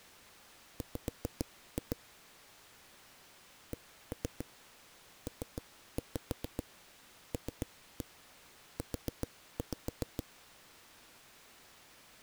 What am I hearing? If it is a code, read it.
Tap code, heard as knocks on a wall, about 7 knocks a second. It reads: W CPLU